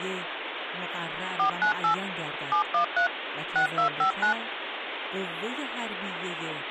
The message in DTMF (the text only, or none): 498 713 6259